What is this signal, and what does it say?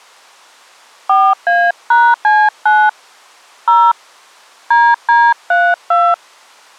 DTMF, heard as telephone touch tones, dialled by hand, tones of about 240 ms. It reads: 4A#C9 0 DD32